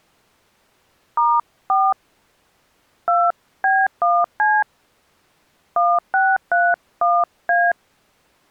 DTMF, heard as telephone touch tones, dialled by hand, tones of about 230 ms. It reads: *4 2B1C 1631A